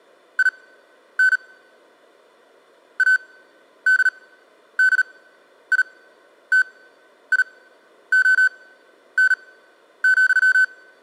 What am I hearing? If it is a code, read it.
Morse code, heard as electronic beeps, machine-sent, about 38 wpm, spaced as for 11 wpm, 1500 Hz. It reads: IN ADDITION,